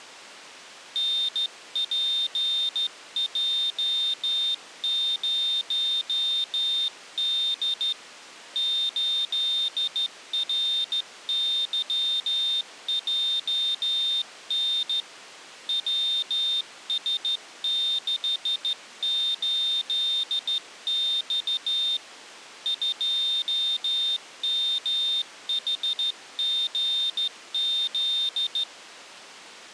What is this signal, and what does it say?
Morse code, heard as a high beeper, hand-sent with a straight key, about 14 wpm, 3650 Hz. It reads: NPJ0D 8RYJN WS68X 2MHGZ